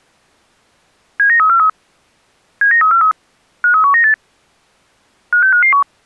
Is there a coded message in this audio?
Yes: five-tone selective call (CCIR) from 1.2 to 5.8 s, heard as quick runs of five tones, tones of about 100 ms. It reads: 79343 79343 53198 56551